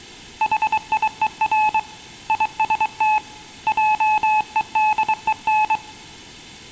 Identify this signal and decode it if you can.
Morse code, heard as a keyed tone, hand-sent with a paddle, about 23 wpm, 860 Hz, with room echo. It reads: HIER IST JEDEN